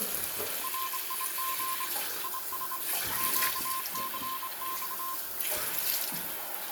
Morse code, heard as a keyed tone, hand-sent with a straight key, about 25 wpm, 1050 Hz, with radio static, a narrow filter, room echo and the noise of a restroom. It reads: RIG IS QCX